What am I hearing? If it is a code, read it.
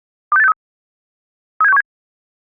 Five-tone selective call (EEA), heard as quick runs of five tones, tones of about 40 ms. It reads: 26863 37617